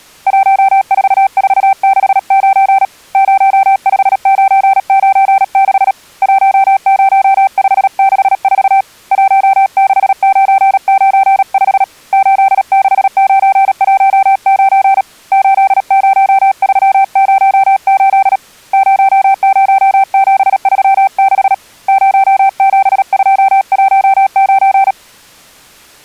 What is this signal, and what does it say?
Morse code, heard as a keyed tone, hand-sent with a paddle, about 37 wpm, 780 Hz. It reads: 14469 05996 10564 16995 86919 80308 00736 07219